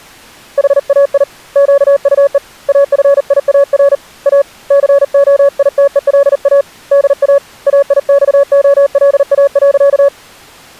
Morse code, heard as a keyed tone, hand-sent with a paddle, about 39 wpm, 560 Hz. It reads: HAI QUE AFIAR A COITELA DA AIXOLA.